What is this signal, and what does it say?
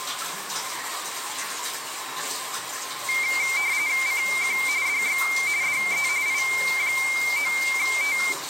RTTY (45.45 baud, 170 Hz shift), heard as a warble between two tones, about 2200 Hz centre, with the noise of a restroom. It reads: CQ DX DE I9T